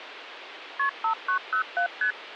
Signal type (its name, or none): multi-frequency trunk signalling